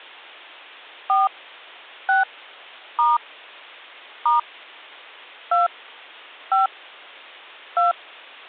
DTMF, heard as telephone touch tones, dialled by hand, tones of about 160 ms. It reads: 4 6 * * 2 5 2